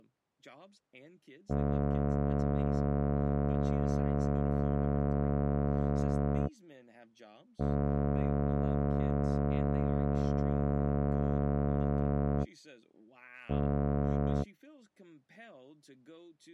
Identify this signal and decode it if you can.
Ship horn signal, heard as a ship's horn, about 70 Hz, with speech in English. 2 long, 1 short. At sea: I intend to overtake on your starboard side.